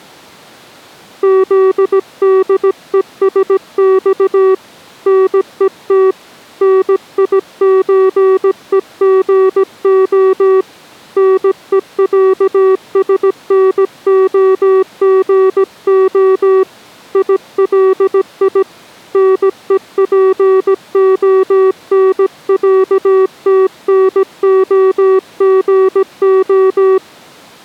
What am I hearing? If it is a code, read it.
Morse code (Russian alphabet), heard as a keyed tone, hand-sent with a paddle, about 17 wpm, 380 Hz. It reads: ЗДЕСЬ НЕТ НИЧЕГО НЕЯСНОГО ИЛИ НЕПОНЯТНОГО